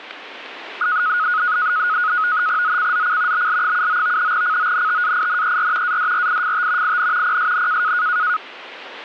NAVTEX (SITOR-B), 100 baud, 170 Hz shift, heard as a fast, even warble, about 1360 Hz centre. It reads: ZCZC BL79 CONTAINER ADRIFT IN PSN